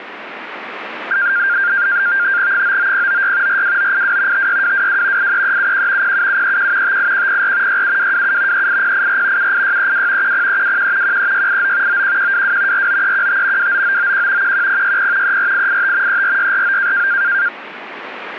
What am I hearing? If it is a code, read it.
NAVTEX (SITOR-B), 100 baud, 170 Hz shift, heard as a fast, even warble, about 1500 Hz centre, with radio static. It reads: 99096 42982 56222 83371 07731 58104 67227 38084 78632 10321 13689 91122 49315 29991 11060 34885 34649